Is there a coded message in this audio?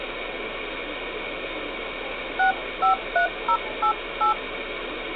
Yes: DTMF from 2.4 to 4.3 s, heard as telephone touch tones, dialled by hand, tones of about 100 ms, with phone line noise. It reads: 653088